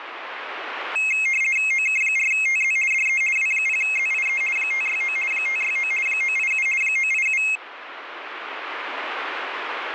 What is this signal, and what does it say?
RTTY (50 baud, 450 Hz shift), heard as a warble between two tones, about 2350 Hz centre, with radio static. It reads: OK4TZ DE W0ZIE 569 569 987 987